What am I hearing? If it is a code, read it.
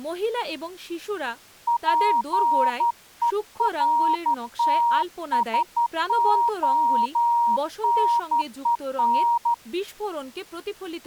Morse code, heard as a keyed tone, hand-sent with a straight key, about 12 wpm, 940 Hz, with speech in Bangla. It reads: PERTSONEN